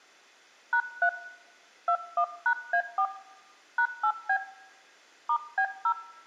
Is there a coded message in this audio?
Yes: DTMF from 0.7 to 5.9 s, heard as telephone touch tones, dialled by hand, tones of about 80 ms, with room echo. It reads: #3 21#A4 #8B *B0